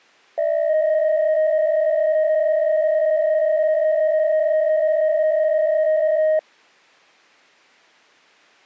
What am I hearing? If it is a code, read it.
PSK63 (62.5 baud), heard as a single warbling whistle, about 620 Hz.